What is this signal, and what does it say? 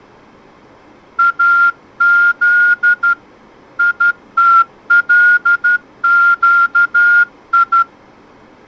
Morse code (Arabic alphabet), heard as a whistle, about 12 wpm. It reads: اذ يتلقي